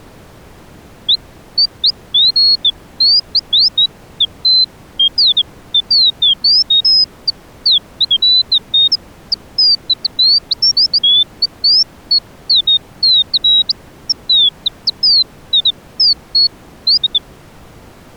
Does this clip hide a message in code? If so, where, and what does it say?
No, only bird-like chirps.